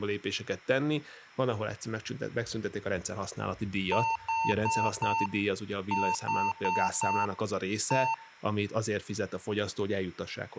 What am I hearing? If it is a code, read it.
Beep code, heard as beeps from a small speaker, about 900 Hz, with room echo and speech in Hungarian. 4-4-1. In Phoenix BIOS tables: serial port failure.